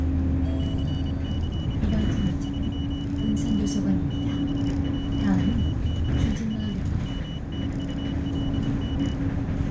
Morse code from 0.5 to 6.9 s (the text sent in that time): CCW3Y 7WMCA